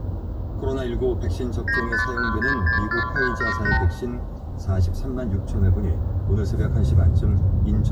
Multi-frequency trunk signalling (R2, with the far end's replies), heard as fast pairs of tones, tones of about 120 ms, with room echo and the noise inside a car. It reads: 951664378